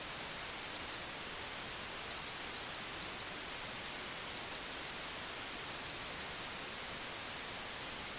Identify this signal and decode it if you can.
Beep code, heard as a piezo beeper, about 4150 Hz. 1-3-1-1. In Phoenix BIOS tables: memory refresh test failure.